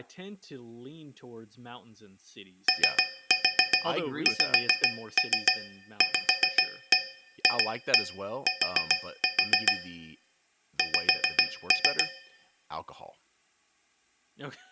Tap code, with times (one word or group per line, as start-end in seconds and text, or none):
2.7-9.7 OXVFT
10.8-12.0 X